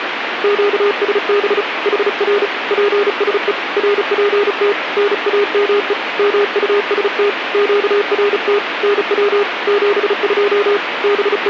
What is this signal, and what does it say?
Morse code, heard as a keyed tone, hand-sent with a paddle, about 35 wpm, 410 Hz, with radio static. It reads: QSB HR PSE RPT NAME MUST QRT NW 72 …